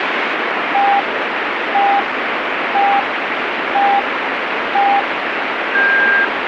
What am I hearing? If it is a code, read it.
Radio time signal (five pips and a higher one, as on Chinese radio), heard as pips, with radio static.